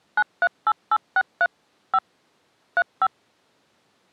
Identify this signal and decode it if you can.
DTMF, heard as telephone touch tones, dialled by machine, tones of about 50 ms. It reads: 938863 5 35